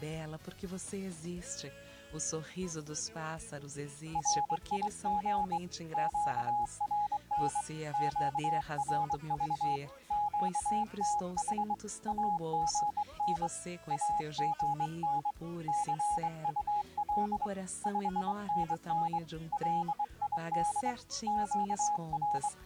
Morse code, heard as a keyed tone, hand-sent with a straight key, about 23 wpm, 830 Hz. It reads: RIG QRN QRV QTH AGN AGN CUL 5NN LID …